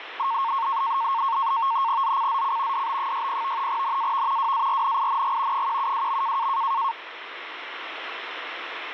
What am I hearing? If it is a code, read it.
NAVTEX (SITOR-B), 100 baud, 170 Hz shift, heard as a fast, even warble, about 1000 Hz centre, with radio static. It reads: ZCZC DB60 NAV WARNING 172.